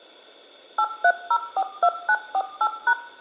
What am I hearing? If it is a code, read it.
DTMF, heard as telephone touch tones, dialled by machine, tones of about 60 ms, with room echo. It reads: 83042948#